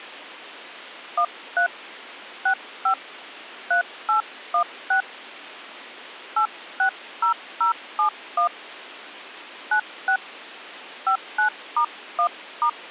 DTMF, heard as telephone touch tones, dialled by hand, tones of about 100 ms. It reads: 13 65 3816 860071 96 59*1*